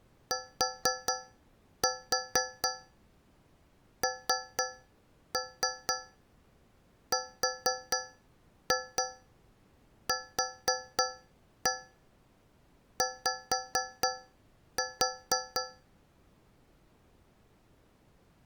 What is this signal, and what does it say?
Tap code, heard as taps on a metal pipe, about 4 knocks a second. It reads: TNRQY